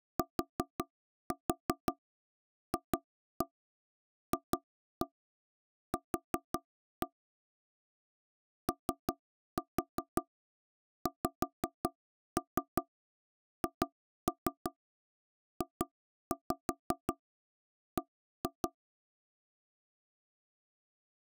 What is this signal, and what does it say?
Tap code, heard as knocks on wood, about 5 knocks a second. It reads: TFFQ OXHJB